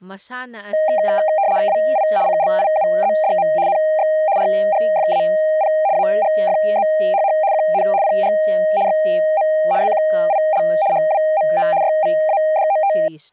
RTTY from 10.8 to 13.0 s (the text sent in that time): HWMO YVADOT